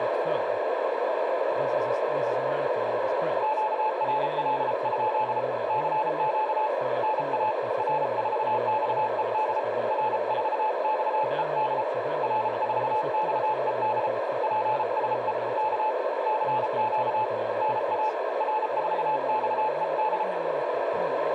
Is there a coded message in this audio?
Yes: Morse code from 3.4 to 20.3 s, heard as a keyed tone, hand-sent with a paddle, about 33 wpm, 860 Hz, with radio static, a narrow filter and speech in Swedish. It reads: QRL? CQ NA R4XED R4XED R4XED PSE K CQ NA R4XED